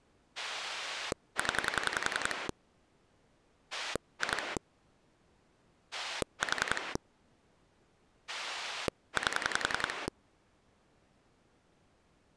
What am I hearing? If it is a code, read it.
Pulse dialling, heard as a rotary dial, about 10 pulses a second. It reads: 0 2 4 8